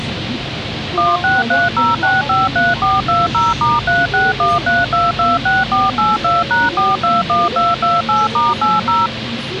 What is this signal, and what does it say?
DTMF, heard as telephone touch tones, dialled by machine, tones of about 180 ms, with radio hiss and the noise inside a bus. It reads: 1630653420*3613226482#421228*80